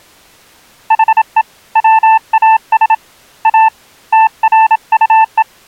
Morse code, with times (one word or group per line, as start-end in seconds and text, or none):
0.9-1.4 HE
1.8-2.9 WAS
3.5-3.7 A
4.1-5.4 TRUE